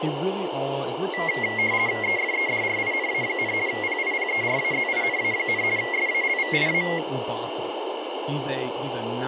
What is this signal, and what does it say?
RTTY (50 baud, 170 Hz shift), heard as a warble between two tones, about 2050 Hz centre, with radio static and speech in English. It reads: EFEDRINA, PIPERAZINA, SALVIA